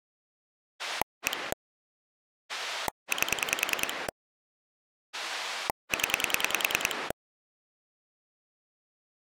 Pulse dialling, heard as a rotary dial, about 10 pulses a second. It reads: 1 8 0